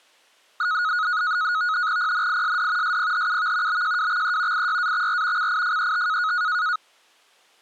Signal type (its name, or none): NAVTEX (SITOR-B)